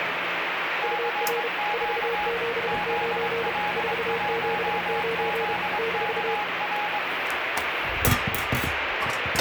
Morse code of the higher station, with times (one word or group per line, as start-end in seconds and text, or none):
0.8-2.3 CQ
2.7-7.0 ZL1ZKR